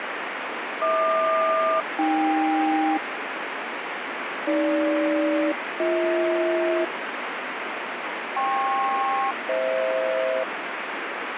Aircraft SELCAL, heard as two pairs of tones, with heavy radio static. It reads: HQ-AK AG-BH KP-FH